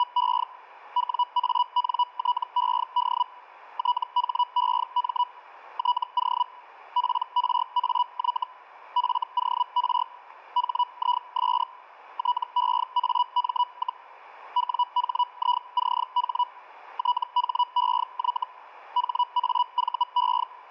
Hellschreiber (Feld-Hell, 122.5 baud), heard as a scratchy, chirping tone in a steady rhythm, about 980 Hz. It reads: … WANTED THEM TO PRAY FOR HIS TEAM, WHICH THEY HAVE